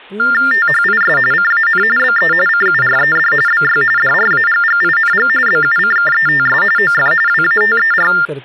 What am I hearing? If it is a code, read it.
TTY/TDD text telephone tones (45.45 baud Baudot), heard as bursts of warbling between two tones, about 400 Hz shift, 1600 Hz centre, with speech in Hindi. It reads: THIS CAN BE CURED BY DRAGGING BUCKETS OF WATER